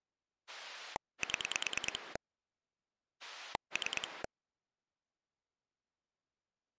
Pulse dialling, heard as a rotary dial, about 9 pulses a second. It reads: 7 3